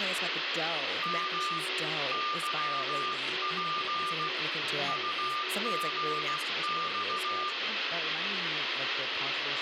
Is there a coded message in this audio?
Yes: Morse code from 1.0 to 7.6 s, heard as a keyed tone, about 16 wpm, 1200 Hz, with radio static, a weaker station near 370 Hz, room echo and speech in English. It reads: M YP UGX